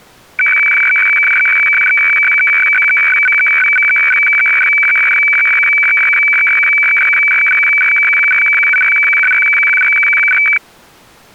Weather fax (radiofax), 120 lines a minute, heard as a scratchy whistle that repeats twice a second.